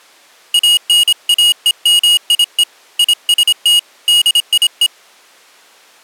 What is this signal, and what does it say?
Morse code, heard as a high beeper, hand-sent with a paddle, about 26 wpm, 2900 Hz. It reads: ANAEMIE IST DIE